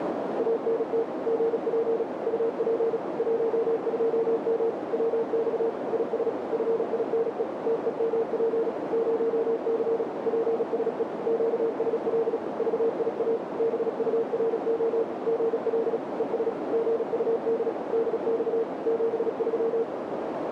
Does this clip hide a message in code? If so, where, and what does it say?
Yes: Morse code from 0.3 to 19.9 s, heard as a keyed tone, machine-sent, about 36 wpm, 460 Hz, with heavy radio static and a narrow filter. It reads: ANT GP UP 12M WX IS FINE TEMP 0C PSE QSL VIA BURO GL ES GUD DX 73